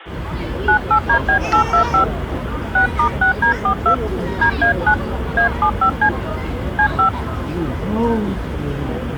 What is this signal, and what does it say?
DTMF, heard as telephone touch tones, dialled by hand, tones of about 100 ms, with hum and the noise of a residential street. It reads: 98DB825 6*6D42 DA9 A75C C5